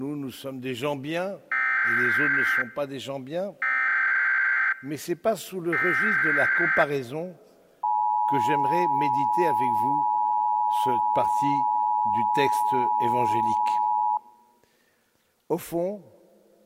Emergency Alert System (SAME) tones (header bursts, then the 853 and 960 Hz attention tone), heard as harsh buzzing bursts, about 520.83 baud.